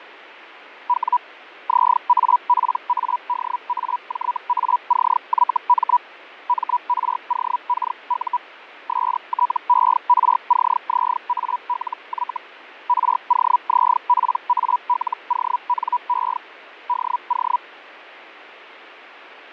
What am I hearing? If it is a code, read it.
Hellschreiber (Feld-Hell, 122.5 baud), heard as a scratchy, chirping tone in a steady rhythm, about 980 Hz, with fading. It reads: W ZAPADAJACYM MROKU STERCZALY ROZPALONE DO